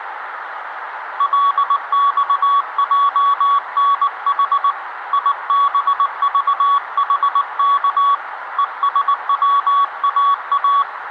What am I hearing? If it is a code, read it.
Morse code, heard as a keyed tone, hand-sent with a paddle, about 19 wpm, 1130 Hz, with radio static and room echo. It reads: LXJNH IBVHK ESWAA